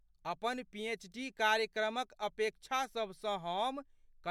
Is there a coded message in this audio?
No, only speech in Maithili.